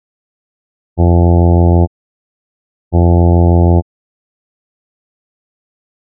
Ship horn signal, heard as a ship's horn, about 90 Hz. 2 short. At sea: I am altering course to port.